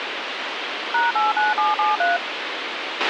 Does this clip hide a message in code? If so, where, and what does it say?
Yes: DTMF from 0.9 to 2.2 s, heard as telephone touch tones, dialled by machine, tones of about 170 ms, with radio hiss and a squelch burst at the end. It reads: #89773